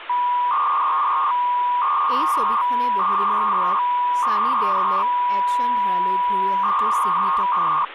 300-baud modem data (V.21 tones), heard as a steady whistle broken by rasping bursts, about 300 baud, 200 Hz shift, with phone line noise and speech in Assamese.